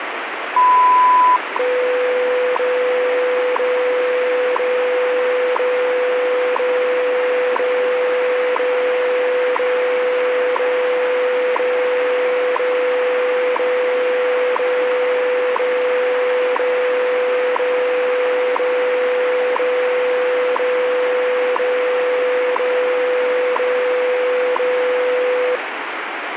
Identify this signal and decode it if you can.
Radio time signal (WWV, Colorado), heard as ticks, one a second, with radio static.